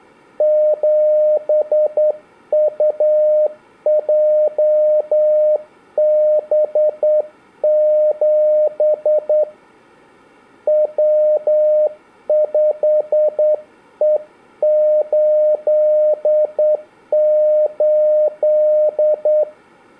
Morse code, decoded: 7UJB7 W5E88

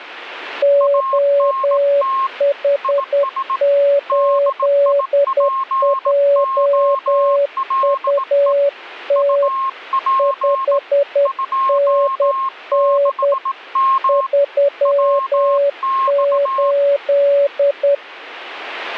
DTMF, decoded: none

